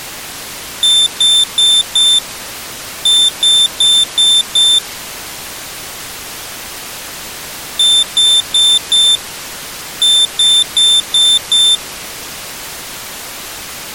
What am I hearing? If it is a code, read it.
Beep code, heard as a piezo beeper, played twice, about 3550 Hz. 4-5.